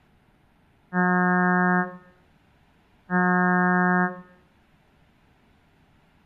Ship horn signal, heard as a ship's horn, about 180 Hz, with room echo. 2 short. At sea: I am altering course to port.